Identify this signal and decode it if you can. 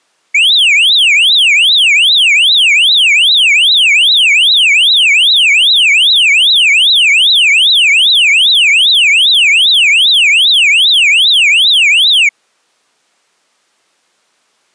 A tone that sweeps in pitch again and again. There is no code.